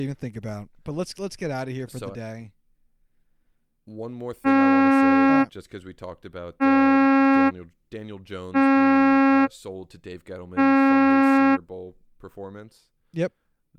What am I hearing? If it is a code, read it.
Ship horn signal, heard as a ship's horn, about 270 Hz, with speech in English. 4 short. At sea: a pilot vessel's identity signal in fog.